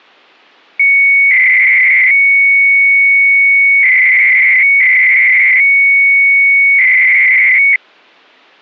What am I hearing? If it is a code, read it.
300-baud modem data (Bell 103 tones), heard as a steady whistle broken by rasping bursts, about 300 baud, 200 Hz shift.